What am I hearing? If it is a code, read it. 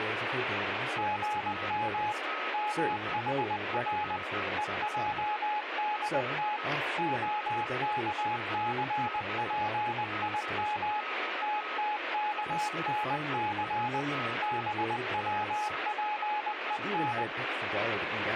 Morse code (Hebrew alphabet), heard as a keyed tone, machine-sent, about 20 wpm, 840 Hz, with radio static, a weaker station near 1270 Hz and speech in English. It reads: גם מחר ועדת הכספים תתכנס בצפון